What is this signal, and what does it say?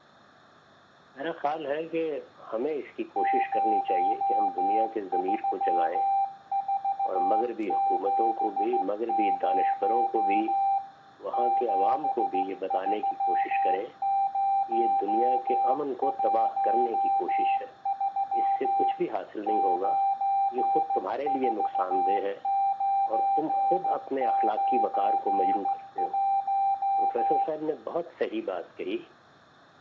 Morse code, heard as a keyed tone, hand-sent with a straight key, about 15 wpm, 790 Hz, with room echo. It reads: 03470 73013 94991